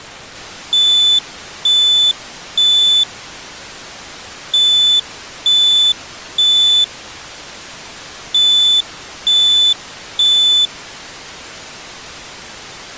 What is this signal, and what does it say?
Alarm pattern, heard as an alarm's beeps, played three times, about 3500 Hz. Temporal three. Smoke or fire, evacuate.